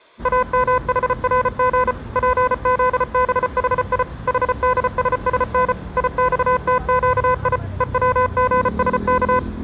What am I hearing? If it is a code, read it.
Morse code (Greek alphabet), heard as electronic beeps, machine-sent, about 34 wpm, 500 Hz, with room echo and street noise. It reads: ΑΜΗΡΓ ΠΖΒΗΙ ΗΔΣΣΝ ΙΞΤΨΙ ΕΩΓΣΚ